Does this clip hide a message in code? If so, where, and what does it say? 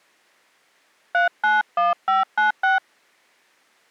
Yes: DTMF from 1.1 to 2.8 s, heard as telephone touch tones, dialled by hand, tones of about 160 ms. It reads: 391596